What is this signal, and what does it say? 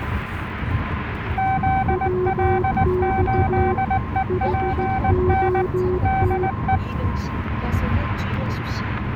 Morse code, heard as two keyed tones, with static crashes and the noise inside a car. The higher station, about 19 wpm, 770 Hz: ZL8EPN DE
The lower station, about 15 wpm, 370 Hz: WX HOT